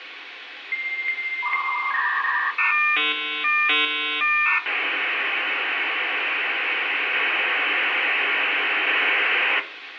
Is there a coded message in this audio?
Yes: dial-up modem handshake (V.34 or later) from 0.7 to 9.6 s, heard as a whistle, warbles, then hiss, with phone line noise and room echo.